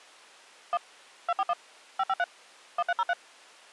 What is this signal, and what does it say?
DTMF, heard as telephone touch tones, dialled by machine, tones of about 40 ms. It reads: 1 241 553 1303